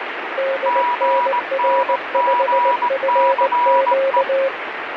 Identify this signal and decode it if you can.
Morse code, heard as two keyed tones, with radio static. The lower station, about 19 wpm, 540 Hz: DNR5FQ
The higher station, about 19 wpm, 970 Hz: GNGCE